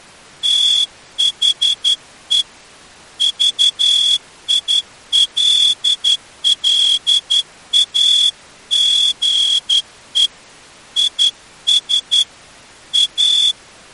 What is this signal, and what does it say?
Morse code, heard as a whistle, hand-sent with a straight key, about 11 wpm. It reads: THE VILLAGE IS A